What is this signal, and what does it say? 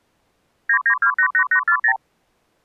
Multi-frequency trunk signalling (R2, with the far end's replies), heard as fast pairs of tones, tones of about 80 ms. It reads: 99288840